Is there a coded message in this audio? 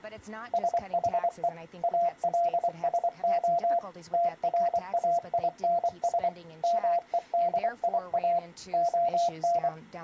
Yes: Morse code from 0.5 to 9.7 s, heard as a keyed tone, machine-sent, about 24 wpm, 690 Hz. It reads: SHE ALSO TRAINS MEDIA ON